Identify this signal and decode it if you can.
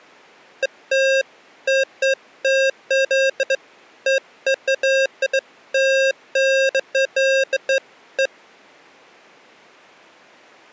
Beeps of irregular length. There is no code.